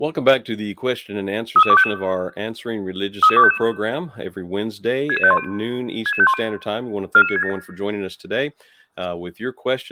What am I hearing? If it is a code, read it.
Five-tone selective call (ZVEI), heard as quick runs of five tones, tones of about 70 ms, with speech in English. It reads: 33255 33255 66510 66510 44967